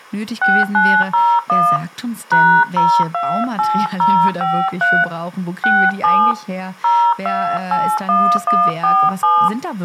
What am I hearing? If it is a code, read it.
DTMF, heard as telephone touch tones, dialled by hand, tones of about 270 ms, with speech in German. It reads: 6901 #028053 67 0281147